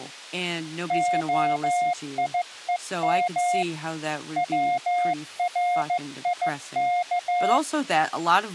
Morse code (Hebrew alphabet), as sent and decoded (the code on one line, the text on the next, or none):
--- .. . -- / .-- .-. .. -.-
היום צריך